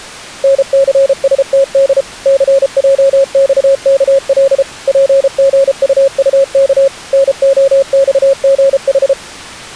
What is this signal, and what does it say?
Morse code, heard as a keyed tone, machine-sent, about 33 wpm, 550 Hz. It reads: NCSTD CJXKL PGUUK NOXGH